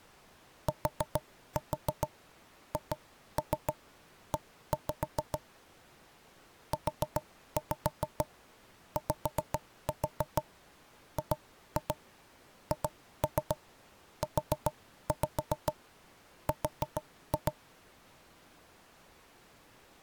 Tap code, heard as knocks on wood, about 6 knocks a second. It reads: THE UYGHUR